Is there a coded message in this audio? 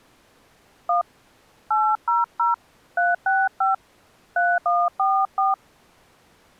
Yes: DTMF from 0.9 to 5.5 s, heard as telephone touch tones, dialled by hand, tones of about 210 ms. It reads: 1 800 365 3144